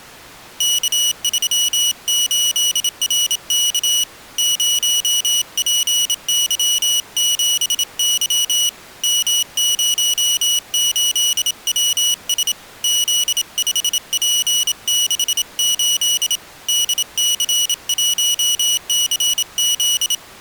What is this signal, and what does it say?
Morse code, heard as a high beeper, hand-sent with a bug key, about 27 wpm, 2950 Hz. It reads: K38RK 0PY7Y M08WS Z5P68 DC1CZ